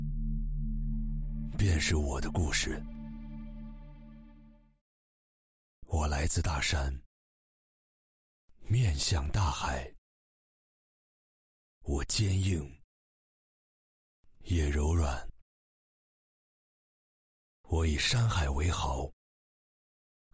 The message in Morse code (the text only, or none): none